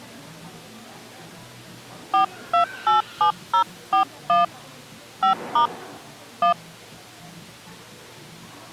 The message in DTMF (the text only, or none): 4287041 5* 1